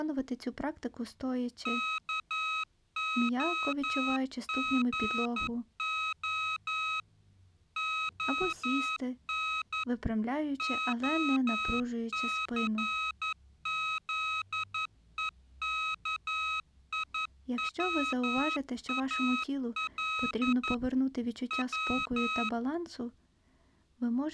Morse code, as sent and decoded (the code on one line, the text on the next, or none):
-.- --- --. --- / --- -. / --- -.-. --.. . -.- .. .-- .- .-.. / .--
KOGO ON OCZEKIWAL W